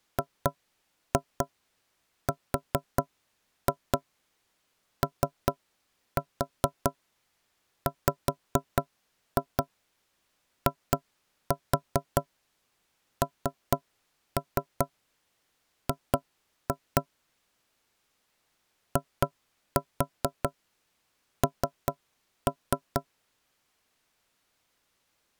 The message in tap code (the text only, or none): GROWING IN